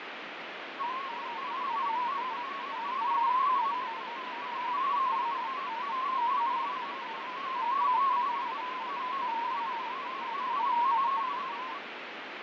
Multi-tone FSK (Olivia or MFSK type), about 250 Hz wide, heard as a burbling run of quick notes, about 31.25 baud, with heavy radio static and fading.